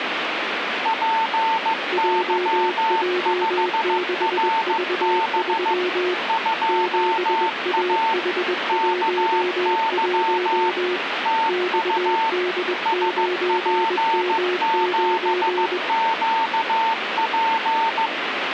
Morse code, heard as two keyed tones, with radio static. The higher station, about 15 wpm, 900 Hz: PY5RB 2A KY TU SP7QP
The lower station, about 21 wpm, 360 Hz: JJ6V3 7AH11 XD9M9